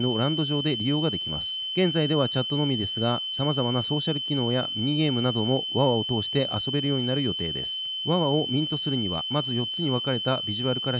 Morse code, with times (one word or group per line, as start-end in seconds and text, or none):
none